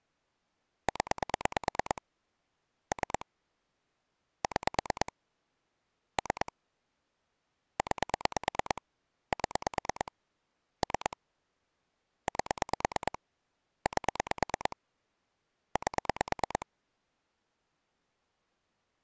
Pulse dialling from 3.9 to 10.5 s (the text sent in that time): 6 3 9 7